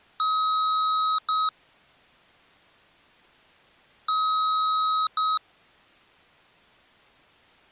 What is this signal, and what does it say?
Beep code, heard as beeps from a small speaker, played twice, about 1270 Hz. 1 long, 1 short. In IBM BIOS tables: system board problem.